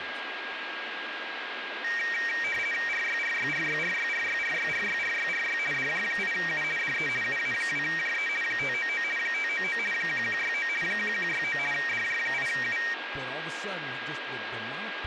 RTTY (50 baud, 450 Hz shift), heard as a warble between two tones, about 2100 Hz centre, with radio static, a steady whistle near 1630 Hz and speech in English. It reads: RYRYRYRYRYRYRYRYRY DJ8U DE UA2JE 599 599 1169 1169 DJ8U